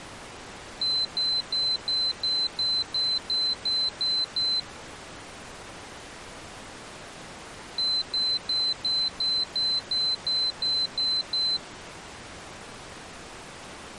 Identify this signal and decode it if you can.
Beep code, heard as a piezo beeper, played twice, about 4050 Hz. 11 short. In AMI BIOS tables: cache memory error.